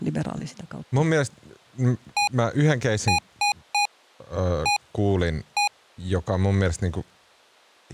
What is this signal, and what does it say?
Beep code, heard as beeps from a small speaker, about 820 Hz, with speech in Finnish. 1-3-1-1. In Phoenix BIOS tables: memory refresh test failure.